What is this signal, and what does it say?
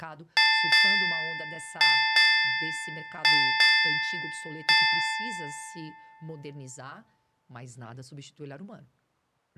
Ship's bell, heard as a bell, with speech in Portuguese. 7. Seven half-hours of the watch have passed.